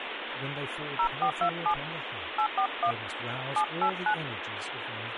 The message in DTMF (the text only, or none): 0427 841 789